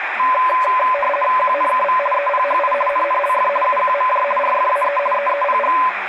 RTTY (50 baud, 450 Hz shift), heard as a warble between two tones, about 800 Hz centre, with radio static and speech in Marathi. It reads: QNKV EPHI NNLF UQMJ RFAE EEPG